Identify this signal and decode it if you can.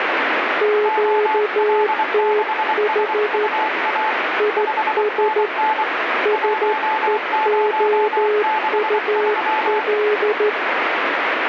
Morse code, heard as two keyed tones, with radio static. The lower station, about 13 wpm, 420 Hz: QTH IS SEOUL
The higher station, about 24 wpm, 870 Hz: OL6SUA 5NN 1063